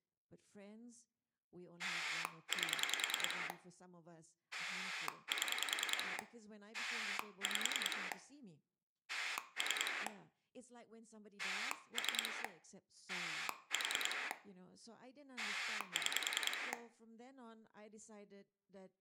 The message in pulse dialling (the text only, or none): 8 7 5 3 3 4 6